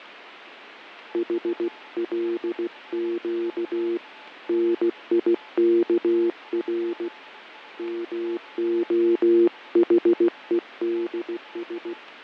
Morse code (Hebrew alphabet), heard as a keyed tone, hand-sent with a paddle, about 16 wpm, 350 Hz, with radio static, fading and a weaker station near 860 Hz. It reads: חלק ניכר מהחודש